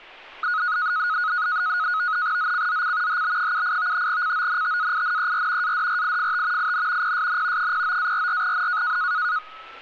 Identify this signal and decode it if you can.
NAVTEX (SITOR-B), 100 baud, 170 Hz shift, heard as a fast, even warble, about 1360 Hz centre, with street noise. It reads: ZCZC HB78 CONTAINER ADRIFT IN PSN 09-44N